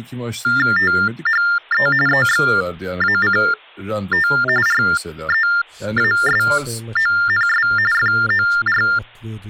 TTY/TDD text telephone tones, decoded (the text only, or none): THE EXACT REASONS FOR